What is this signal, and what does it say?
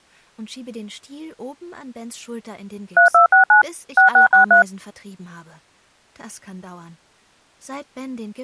DTMF, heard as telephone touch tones, dialled by machine, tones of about 120 ms. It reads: 3269 6663